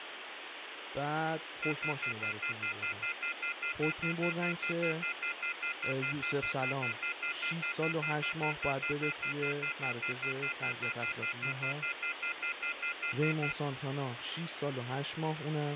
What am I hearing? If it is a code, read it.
Telephone call progress tone (North American plan), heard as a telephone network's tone, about 1400, 2050, 2450, 2600 Hz, 0.1 s on and 0.1 s off, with phone line noise and speech in Persian. Off-hook warning tone.